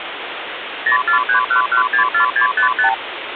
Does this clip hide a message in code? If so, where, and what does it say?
Yes: multi-frequency trunk signalling (R2, with the far end's replies) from 0.9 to 2.9 s, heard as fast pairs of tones, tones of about 110 ms, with phone line noise. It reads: 0431164655